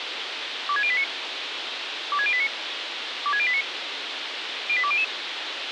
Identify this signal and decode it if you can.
Five-tone selective call (ZVEI), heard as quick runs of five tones, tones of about 70 ms, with radio hiss and a squelch burst at the end. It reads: 26089 26089 26089 08200